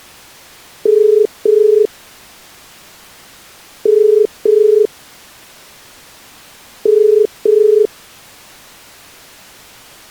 Telephone call progress tone (as in the UK, Ireland, Australia and similar networks), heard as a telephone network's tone, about 430 Hz. Ringback tone.